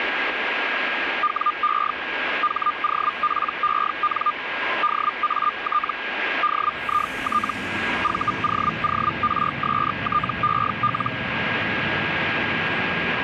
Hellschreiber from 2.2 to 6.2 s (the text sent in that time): HOPEN DAT